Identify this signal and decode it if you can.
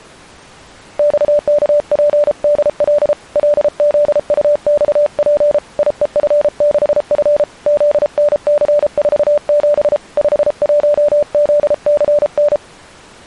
Morse code, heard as a keyed tone, hand-sent with a paddle, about 33 wpm, 590 Hz. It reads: XKPDL LZUXP IEF6F ZNC47 51ZCN